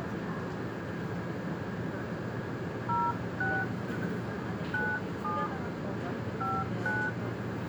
DTMF, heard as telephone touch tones, dialled by hand, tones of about 220 ms, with the noise inside a subway train. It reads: 06 97 59